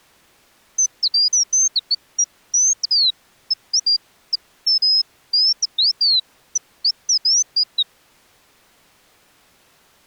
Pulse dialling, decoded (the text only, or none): none